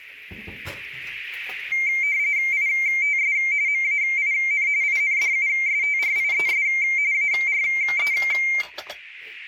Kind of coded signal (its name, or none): RTTY